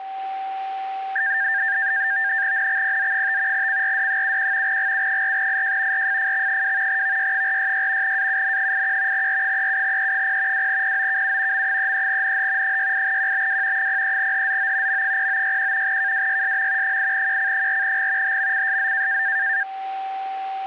NAVTEX (SITOR-B), 100 baud, 170 Hz shift, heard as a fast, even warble, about 1700 Hz centre, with a steady whistle near 770 Hz. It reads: NXPZ5 CRD71 GU4IJ RFFX2 VY466 AUN81 R37E0 2POKU M33NH 68QBW 03HZO M0961 KWYSM 8QC4G HMCSZ